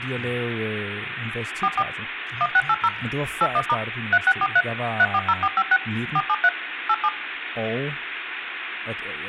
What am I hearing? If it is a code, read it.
DTMF, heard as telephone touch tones, dialled by machine, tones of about 50 ms, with phone line noise and speech in Danish. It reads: 44 1680 81* 3643 340456 473 87